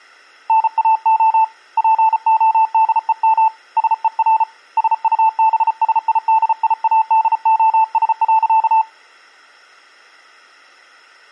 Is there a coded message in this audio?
Yes: Morse code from 0.4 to 8.9 s, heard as a keyed tone, hand-sent with a paddle, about 34 wpm, 890 Hz. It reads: NAO PODEM SER SUBSIDIADOS.